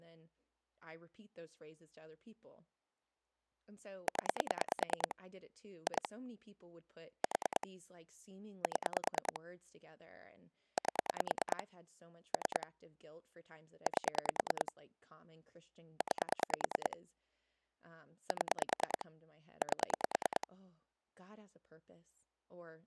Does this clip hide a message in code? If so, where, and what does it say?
Yes: pulse dialling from 4.1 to 20.4 s, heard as clicks on a phone line, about 9 pulses a second, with speech in English. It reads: 0 2 4 7 8 3 8 9 7 8